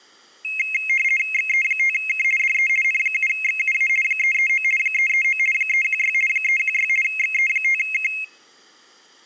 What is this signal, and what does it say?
RTTY (50 baud, 450 Hz shift), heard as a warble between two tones, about 2350 Hz centre. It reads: XE5K DE N7XUA 339 339 316 316 XE5K